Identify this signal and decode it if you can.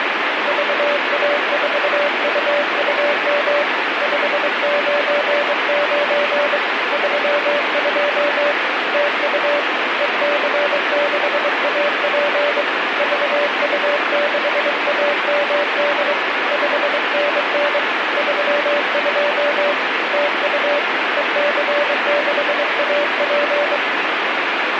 Morse code, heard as a keyed tone, hand-sent with a straight key, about 23 wpm, 580 Hz, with heavy radio static. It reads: VA4UUM 599 32 TU EC6AP VU6AMD 5NN 32 TU EC6AP